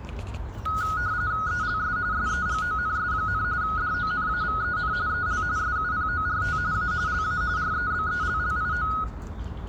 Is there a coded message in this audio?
Yes: RTTY (45.45 baud, 170 Hz shift) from 0.7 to 9.0 s, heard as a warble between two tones, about 1360 Hz centre, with room echo and the noise of a park. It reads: ELS SEGONS, DONAVEN EL SUPORT A LA REBELLIO